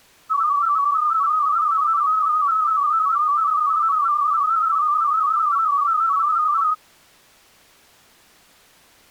Multi-tone FSK (Olivia or MFSK type), about 250 Hz wide, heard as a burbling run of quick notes, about 31.25 baud.